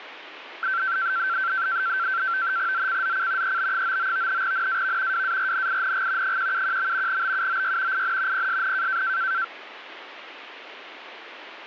NAVTEX (SITOR-B), 100 baud, 170 Hz shift, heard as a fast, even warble, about 1450 Hz centre, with radio static. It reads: ZCZC EB99 NAV WARNING 171. BUOY IN PSN